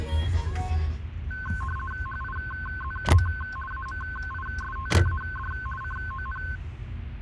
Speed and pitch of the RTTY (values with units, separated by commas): 50 baud, 450 Hz shift, 1290 Hz centre